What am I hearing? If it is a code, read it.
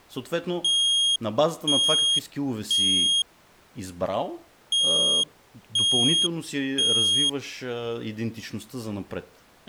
Alarm pattern, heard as an alarm's beeps, played twice, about 3250 Hz, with speech in Bulgarian. Temporal three. Smoke or fire, evacuate.